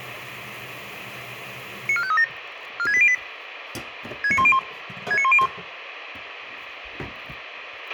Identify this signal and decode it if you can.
Five-tone selective call (ZVEI), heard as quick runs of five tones, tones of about 70 ms, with radio hiss, a squelch burst at the end and kitchen noise. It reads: 94537 46808 69101 69101